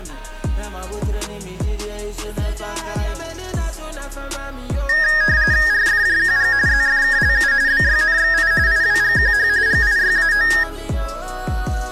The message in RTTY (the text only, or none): RFJQG ZFKLU BYNXI IWGQH GIYAO